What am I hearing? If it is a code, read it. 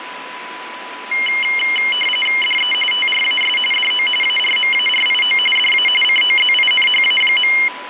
RTTY (45.45 baud, 850 Hz shift), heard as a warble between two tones, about 2550 Hz centre, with radio static and a steady whistle near 990 Hz. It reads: DE TRAS DO ARMARIO DA COZINHA.